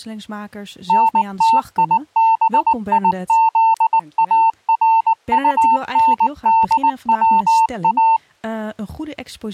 Morse code, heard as a keyed tone, machine-sent, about 19 wpm, 900 Hz, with speech in Dutch. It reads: NTIBIZARUNDWA